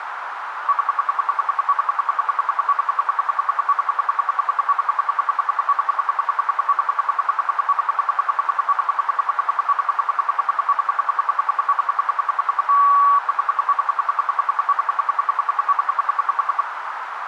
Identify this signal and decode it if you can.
Radio time signal (RWM, Moscow), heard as ten pulses a second, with radio static and a narrow filter.